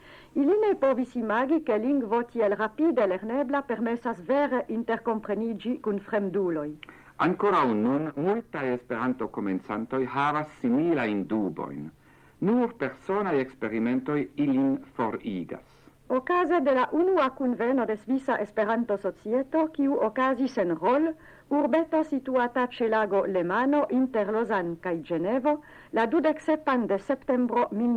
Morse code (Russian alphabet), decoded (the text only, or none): none